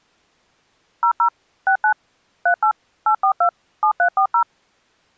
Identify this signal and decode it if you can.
DTMF, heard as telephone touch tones, dialled by machine, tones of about 90 ms. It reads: 00 69 38 842 7340